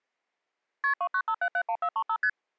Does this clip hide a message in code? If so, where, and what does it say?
Yes: multi-frequency trunk signalling (R1, as on North American trunks) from 0.8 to 2.3 s, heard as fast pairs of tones, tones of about 70 ms. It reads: KP 295771435 ST